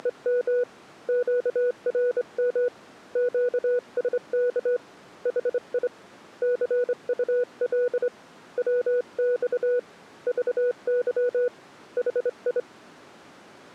Morse code, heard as a keyed tone, hand-sent with a straight key, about 25 wpm, 490 Hz. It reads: … QRM QSK HI CUL WX VY HI